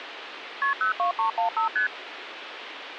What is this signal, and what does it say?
Multi-frequency trunk signalling (R1, as on North American trunks), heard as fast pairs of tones, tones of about 120 ms, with phone line noise. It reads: KP 02315 ST